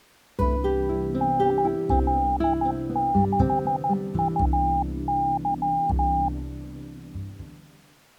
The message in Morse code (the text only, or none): NL6UY